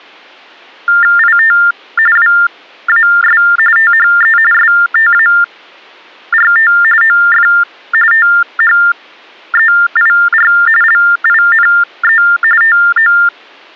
TTY/TDD text telephone tones (45.45 baud Baudot), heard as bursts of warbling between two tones, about 400 Hz shift, 1600 Hz centre. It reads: IT WAS THE START OF THEIR LINE TO